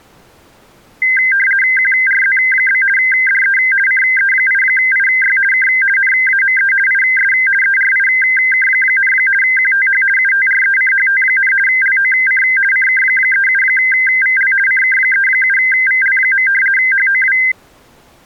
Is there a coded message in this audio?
Yes: RTTY (50 baud, 450 Hz shift) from 1.0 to 17.5 s, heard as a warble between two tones, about 1800 Hz centre. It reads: QRZ? DE CE8IY K NAME IS ERIK, QTH UTRECHT, LOC CK37VL CK37VL. HOW